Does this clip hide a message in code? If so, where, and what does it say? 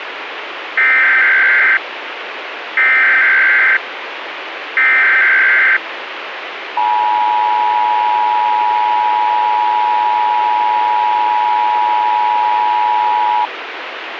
Yes: Emergency Alert System (SAME) tones (header bursts, then the 853 and 960 Hz attention tone) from 0.8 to 13.5 s, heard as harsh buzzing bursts, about 520.83 baud, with radio hiss.